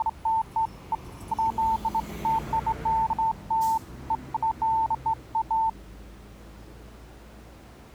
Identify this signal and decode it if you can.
Beeps of irregular length, with street noise. There is no code.